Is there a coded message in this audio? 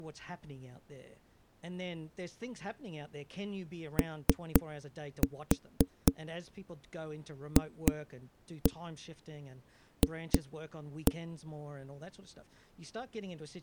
Yes: tap code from 4.0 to 11.2 s, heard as knocks on a wall, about 3 knocks a second, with speech in English. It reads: OFF